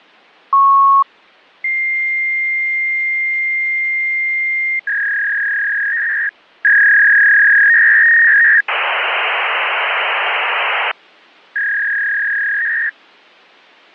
Fax machine handshake, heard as a beep, a long tone, a warble and hiss.